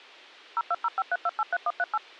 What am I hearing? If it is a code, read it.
DTMF, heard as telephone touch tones, dialled by machine, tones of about 40 ms. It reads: 02053283138